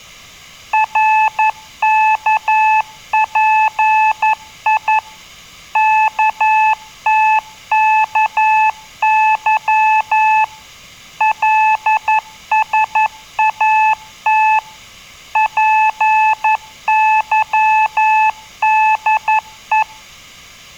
Morse code, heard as a keyed tone, machine-sent, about 11 wpm, 870 Hz. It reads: RKPI KTKY LSAT PYDE